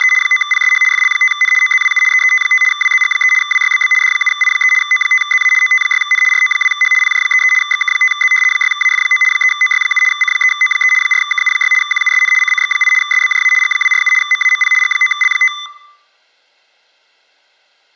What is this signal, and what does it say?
RTTY (75 baud, 850 Hz shift), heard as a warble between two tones, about 1600 Hz centre. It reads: … 9PSH FL5N OZWU EET5 WZG3 WYBB D7I3 O5ZA OT6N RO2H PJ33 XK5Z 6AF9 3OY7 C3O3 4KU6 QUSN CCX8 SBJA G247 MAMP G9L5